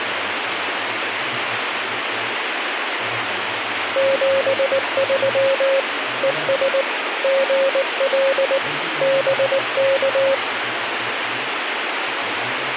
Morse code, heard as a keyed tone, machine-sent, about 19 wpm, 540 Hz, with radio static. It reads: 73 ES GL BK